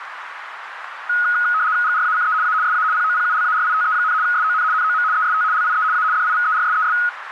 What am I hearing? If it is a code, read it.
RTTY (75 baud, 170 Hz shift), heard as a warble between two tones, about 1360 Hz centre, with radio static and a narrow filter. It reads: GRACE A SA POPULARITE, SON NOM EST LIE A DIVERSES